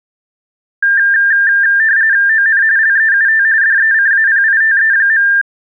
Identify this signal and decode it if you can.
RTTY (45.45 baud, 170 Hz shift), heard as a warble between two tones, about 1700 Hz centre. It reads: ON LEUT DECAPITE.